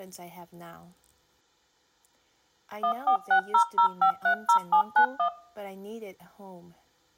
DTMF, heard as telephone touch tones, dialled by machine, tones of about 90 ms. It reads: 14600530791